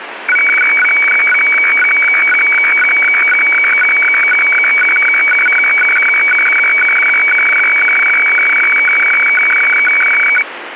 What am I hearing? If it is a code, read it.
Weather fax (radiofax), 120 lines a minute, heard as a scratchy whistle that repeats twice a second, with radio static.